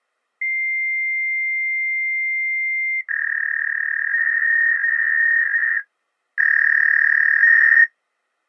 Fax machine handshake, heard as a long tone and a warble.